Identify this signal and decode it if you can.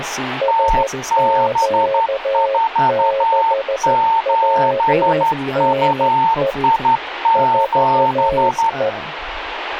Morse code, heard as two keyed tones, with radio static and speech in English. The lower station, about 13 wpm, 540 Hz: SQ6WNE 4E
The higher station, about 12 wpm, 900 Hz: TB47UI7